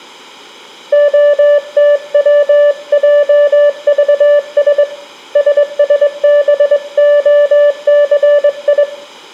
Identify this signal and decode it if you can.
Morse code, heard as a keyed tone, hand-sent with a straight key, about 22 wpm, 580 Hz, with room echo. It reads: OTWJVS SSBOCI